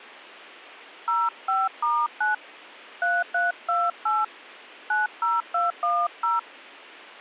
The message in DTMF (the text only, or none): 05*9 3328 90210